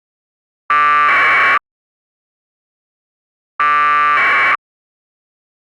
Packet radio (AX.25, as in APRS), 1200 baud, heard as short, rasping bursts.